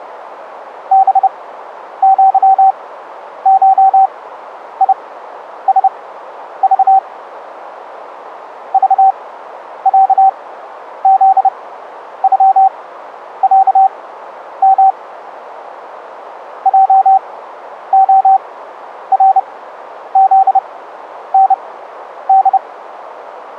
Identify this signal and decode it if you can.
Morse code (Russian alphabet), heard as a keyed tone, machine-sent, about 30 wpm, spaced as for 10 wpm, 770 Hz. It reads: БЪШИСЖ ЖЯЗЮЯМ ЙОРЗНД